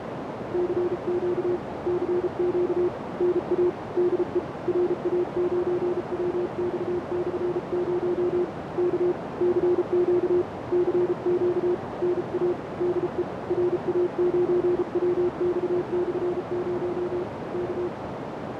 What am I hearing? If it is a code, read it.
Morse code, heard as a keyed tone, hand-sent with a paddle, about 34 wpm, 360 Hz, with heavy radio static and a narrow filter. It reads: CQ CQ NA DE RA9WX/0 K CQ CQ NA DE RA9WX/0 K